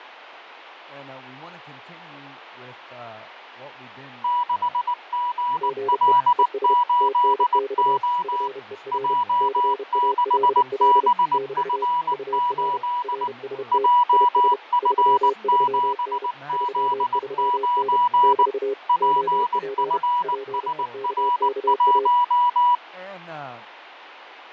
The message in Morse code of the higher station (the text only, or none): 6GL8O J6BF8 JF7Z9 PFSR1